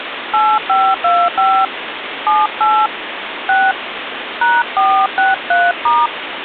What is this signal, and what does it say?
DTMF, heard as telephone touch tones, dialled by hand, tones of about 230 ms, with phone line noise. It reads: 8525 78 6 #463*